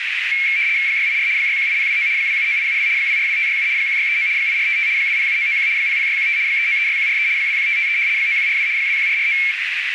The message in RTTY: 684 618029 279872 242567 1639 8455 207991 00615 3936143 21553 9142 21449

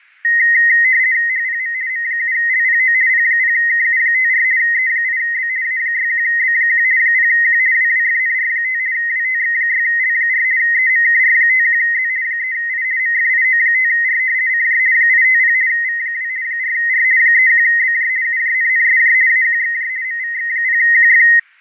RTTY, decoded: HPM M7LPO P0KU54 E8B A61B1 0Q WWFNR5 WTX6L4 EMKR51Z 3I MFIO5R CJ 850 V2 4R 31BJ UJNNSJ AQXJ MVX0QF

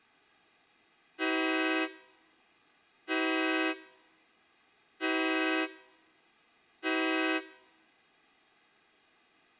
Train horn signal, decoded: 4 short

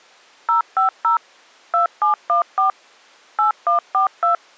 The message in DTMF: 050 2714 8142

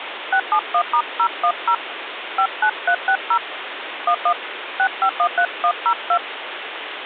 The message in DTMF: 671*010 59360 11 6513102

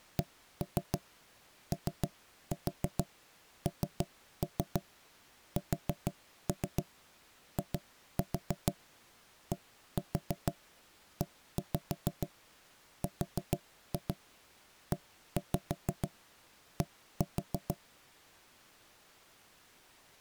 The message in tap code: CONSIDERED

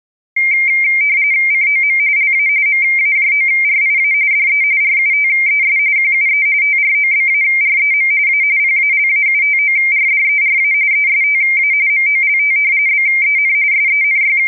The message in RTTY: COM LA MAJORIA DE RUTES QUE TROBAREM A PALAUTORDERA ESTA MOLT BEN …

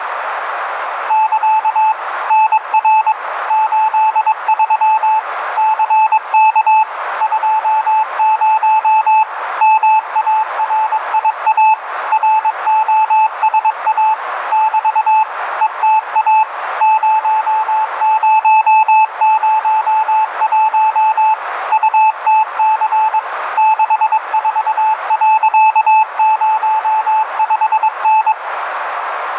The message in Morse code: <KA> NR 83 CK 20 MARIA ROSA <BT> ETA 0001 UTC 64.05N

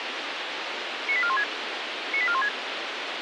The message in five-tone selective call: 98416 98416

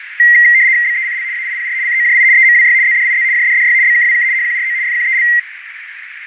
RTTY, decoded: BECL AIPR COJI EMWY ZDIZ JDDY BKWK HQRO FQEL

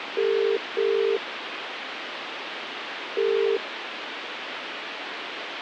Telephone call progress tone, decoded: ringback tone

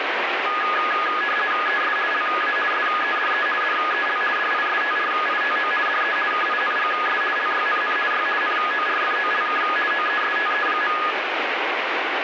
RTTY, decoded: ES LA SEDE DEL DISTRITO DE KINGS LYNN Y NORFOLK OESTE.

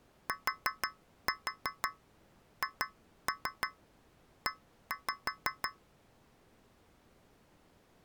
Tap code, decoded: THE

